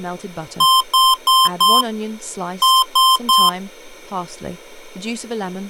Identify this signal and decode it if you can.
Beep code, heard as beeps from a small speaker, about 1040 Hz, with speech in English. 4-3.